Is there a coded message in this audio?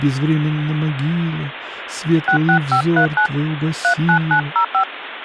Yes: DTMF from 2.3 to 4.8 s, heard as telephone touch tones, dialled by hand, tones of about 90 ms, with phone line noise. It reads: 66539 39905